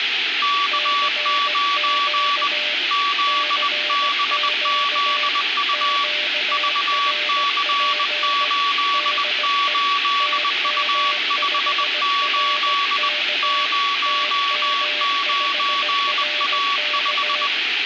Morse code, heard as two keyed tones, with radio static and room echo. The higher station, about 20 wpm, 1140 Hz: K9 ZBZU VC88U58 09A5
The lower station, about 17 wpm, 600 Hz: CQ CQ QRP DE TM5RK TM5RK